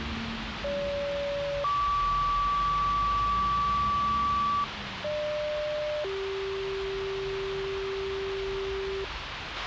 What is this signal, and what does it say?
Two-tone page, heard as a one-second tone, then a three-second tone, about 570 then 1150 Hz, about 600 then 390 Hz, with radio hiss, a squelch burst at the end and the noise of a residential street.